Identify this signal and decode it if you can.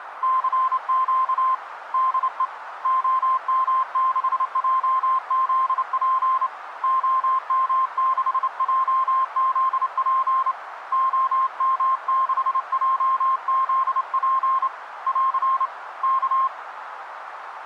Morse code, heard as a keyed tone, hand-sent with a straight key, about 28 wpm, 1050 Hz, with radio static and a narrow filter. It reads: CQ DE OM6JZP OM6JZP OM6JZP <AR> K